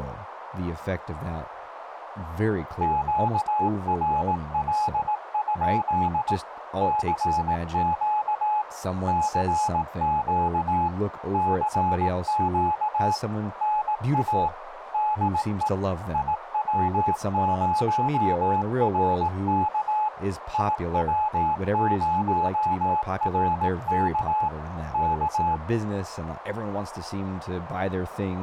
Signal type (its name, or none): Morse code